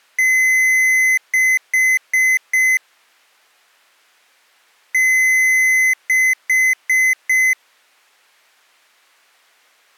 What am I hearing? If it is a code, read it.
Beep code, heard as beeps from a small speaker, played twice, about 2050 Hz. 1 long, 4 short.